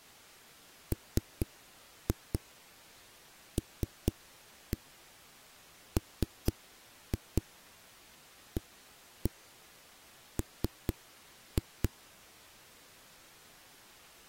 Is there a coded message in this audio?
Yes: tap code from 0.9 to 11.9 s, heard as knocks on a wall, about 4 knocks a second. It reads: MLMAM